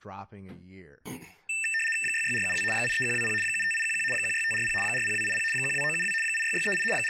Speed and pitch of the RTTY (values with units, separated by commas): 75 baud, 850 Hz shift, 2250 Hz centre